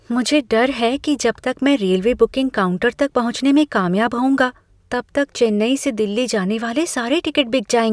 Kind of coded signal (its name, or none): none